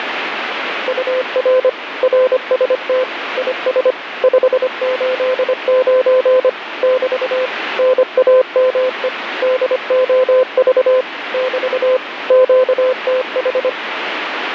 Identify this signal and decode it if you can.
Morse code, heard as a keyed tone, machine-sent, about 25 wpm, 510 Hz, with radio static. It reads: UR RST IS 589 <BT> NAME DOV <BT> QTH